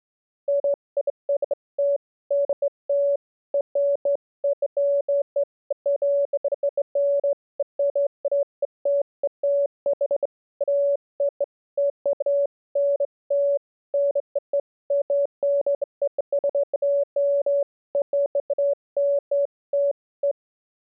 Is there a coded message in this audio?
No, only beeps of irregular length.